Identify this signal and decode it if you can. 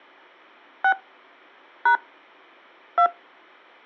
DTMF, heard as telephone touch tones, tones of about 80 ms. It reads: 6 # 2